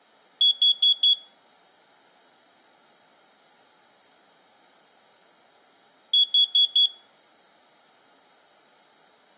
Alarm pattern, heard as an alarm's beeps, played twice, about 3350 Hz. Temporal four. Carbon monoxide.